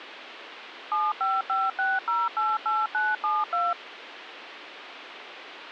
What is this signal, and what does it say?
DTMF, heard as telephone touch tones, dialled by machine, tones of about 200 ms, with phone line noise. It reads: 7556088972